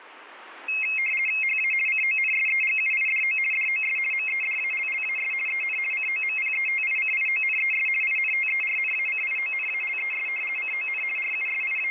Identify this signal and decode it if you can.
RTTY (50 baud, 450 Hz shift), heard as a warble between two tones, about 2350 Hz centre. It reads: HA CONSEGUIDO DOS MEDALLAS EN COMPETICIONES INTERNACIONALES CON …